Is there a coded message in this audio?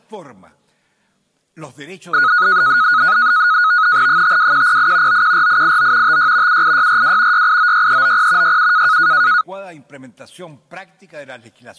Yes: NAVTEX (SITOR-B), 100 baud, 170 Hz shift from 2.1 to 9.4 s, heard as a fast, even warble, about 1360 Hz centre. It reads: 52108 914889 56 78642 6896390 67